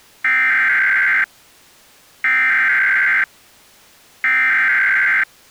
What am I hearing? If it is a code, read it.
Emergency Alert System (SAME) tones (header bursts), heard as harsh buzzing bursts, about 520.83 baud.